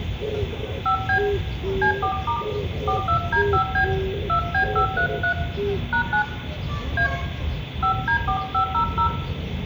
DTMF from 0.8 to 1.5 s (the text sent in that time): 5B